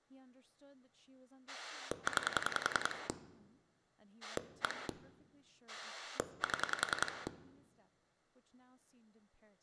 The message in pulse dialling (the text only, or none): 9 1 7